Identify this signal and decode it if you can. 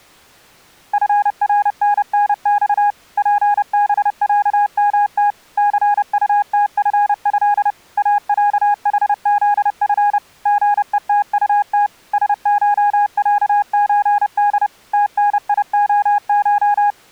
Morse code (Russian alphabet), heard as a keyed tone, machine-sent, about 30 wpm, 820 Hz. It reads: ФРННЬ ПБЯМТ ЦУТФЭ АЯХЗФ ГЕТУТ СШЯЧД ТНИОШ